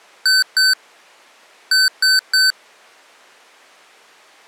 Beep code, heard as beeps from a small speaker, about 1550 Hz. 2-3.